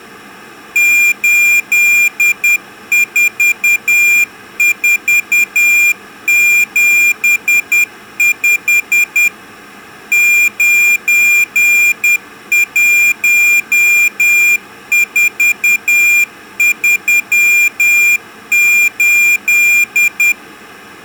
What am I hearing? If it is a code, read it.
Morse code, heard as a high beeper, machine-sent, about 10 wpm, 2400 Hz. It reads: 84475 91438